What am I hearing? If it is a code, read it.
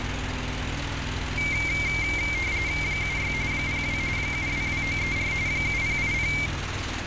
RTTY (45.45 baud, 170 Hz shift), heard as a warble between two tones, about 2200 Hz centre, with radio static and street noise. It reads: 76 02 722934 7080